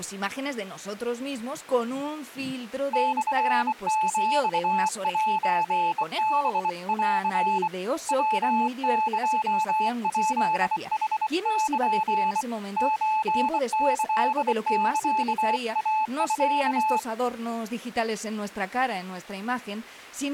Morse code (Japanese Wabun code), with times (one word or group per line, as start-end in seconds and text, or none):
2.9-7.7 モヒセハン
8.1-12.4 ヤエヱヌル
12.8-17.0 ソキサイミ